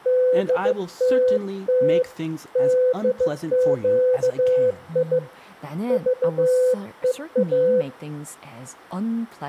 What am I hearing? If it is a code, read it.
Morse code, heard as a keyed tone, hand-sent with a bug key, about 15 wpm, 510 Hz, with speech in Korean. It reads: DTT DQI VEA